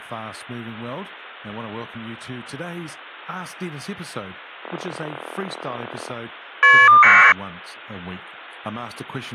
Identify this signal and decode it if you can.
Caller ID data burst, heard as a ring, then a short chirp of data, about 1200 baud, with speech in English.